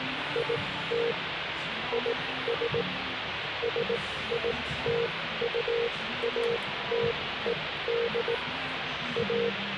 Morse code, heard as a keyed tone, machine-sent, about 18 wpm, spaced as for 14 wpm, 470 Hz, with radio static and the noise of a cafe. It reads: IT IS SITUATED A